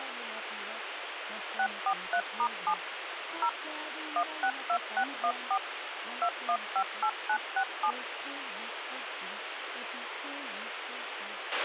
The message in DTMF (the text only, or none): 643*7 0 162614 2158967